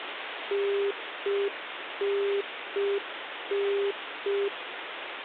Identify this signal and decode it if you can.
Telephone call progress tone (UK plan), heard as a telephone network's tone, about 400 Hz, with phone line noise. Congestion tone.